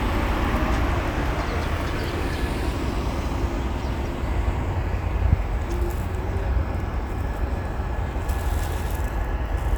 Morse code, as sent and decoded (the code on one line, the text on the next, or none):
none